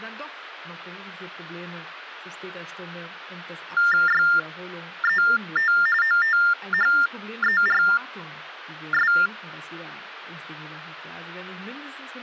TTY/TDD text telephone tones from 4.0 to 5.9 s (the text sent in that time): YET